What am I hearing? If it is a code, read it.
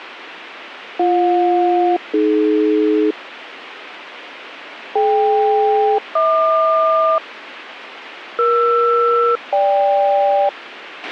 Aircraft SELCAL, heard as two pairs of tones, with radio hiss and a squelch burst at the end. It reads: BJ-AD DK-HQ ER-GK